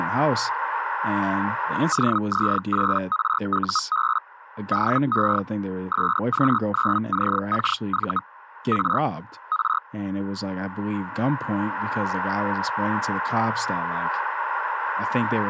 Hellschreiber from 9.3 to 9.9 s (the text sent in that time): R